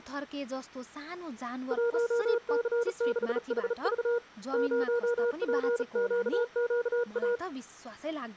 Morse code, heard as a keyed tone, hand-sent with a bug key, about 36 wpm, 480 Hz, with speech in Nepali. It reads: 1C6HV 0PQQA